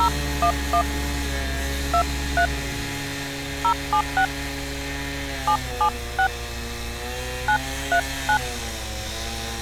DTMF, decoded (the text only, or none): 011 23 076 776 939